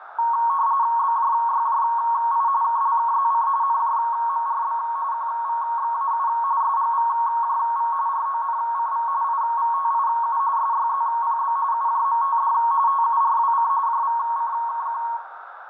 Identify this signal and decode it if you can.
RTTY (45.45 baud, 170 Hz shift), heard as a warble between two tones, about 1010 Hz centre, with radio static, a narrow filter and room echo. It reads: BJYJI KLKZC NJMRB QVXAU SGVJV RONCV IVTIU SYZPB UJMTD TURWC JVCKQ